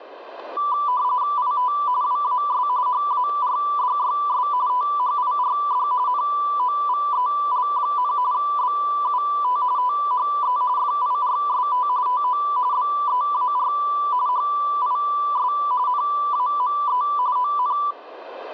RTTY (45.45 baud, 170 Hz shift), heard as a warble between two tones, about 1080 Hz centre, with room echo. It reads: IT WAS HARDYS THIRD NOVEL, BUT THE FIRST TO BEAR HIS NAME ON